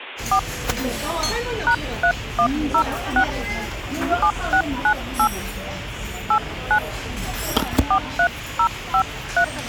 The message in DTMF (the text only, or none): 4 #3106 7698 89 43053